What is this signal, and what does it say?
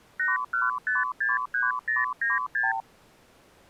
Multi-frequency trunk signalling (R2, with the far end's replies), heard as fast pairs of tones, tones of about 170 ms. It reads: 81563096